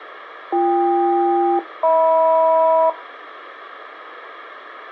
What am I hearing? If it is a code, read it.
Aircraft SELCAL, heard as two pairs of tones. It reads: BK-HM